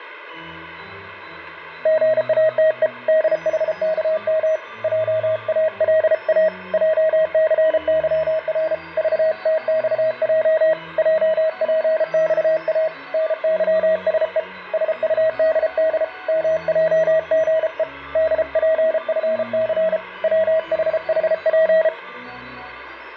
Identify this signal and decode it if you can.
Morse code, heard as a keyed tone, hand-sent with a paddle, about 33 wpm, 640 Hz. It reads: GATE DHKM JALA JCYR VTXJ JPXA NYSE SUDD MJGE DPFC WHHP